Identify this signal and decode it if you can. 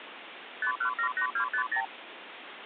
Multi-frequency trunk signalling (R2, with the far end's replies), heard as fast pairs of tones, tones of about 90 ms, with phone line noise. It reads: 5178250